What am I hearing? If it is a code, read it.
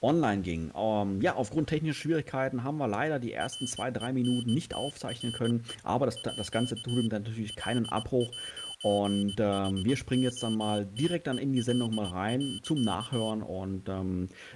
Morse code (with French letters), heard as a high beeper, machine-sent, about 20 wpm, 3050 Hz. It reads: RENTRE À L'HOTEL.